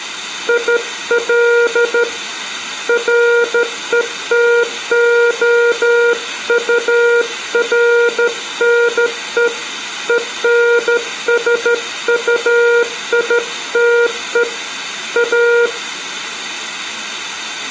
Morse code, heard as a keyed tone, hand-sent with a straight key, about 13 wpm, 470 Hz, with room echo. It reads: IL RETOURNE ENSUITE A